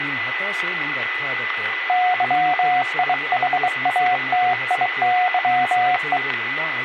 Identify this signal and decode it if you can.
Morse code, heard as a keyed tone, hand-sent with a bug key, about 23 wpm, 730 Hz, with radio static, a steady whistle near 2000 Hz and speech in Kannada. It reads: YIHATIYE